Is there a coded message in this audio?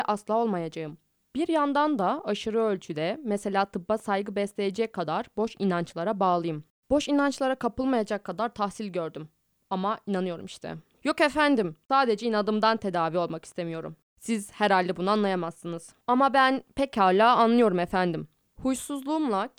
No, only speech in Turkish.